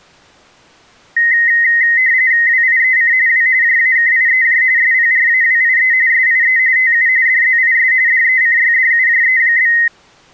RTTY (45.45 baud, 170 Hz shift), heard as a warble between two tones, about 1950 Hz centre. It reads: WIEC W JAKIEJ SPRAWIE SIE TU DZIS DECYDUJE?